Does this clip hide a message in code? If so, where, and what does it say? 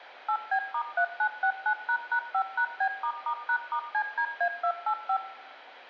Yes: DTMF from 0.3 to 5.2 s, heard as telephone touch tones, dialled by machine, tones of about 80 ms, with a squelch burst at the end and room echo. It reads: 8B*3969##5#B**#*CDA285